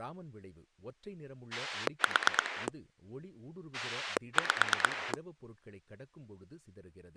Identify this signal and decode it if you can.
Pulse dialling, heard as a rotary dial, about 9 pulses a second, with speech in Tamil. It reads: 4 5